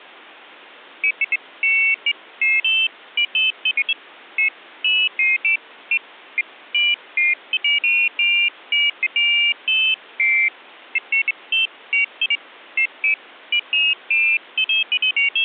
Pairs of high tones at irregular times. There is no code.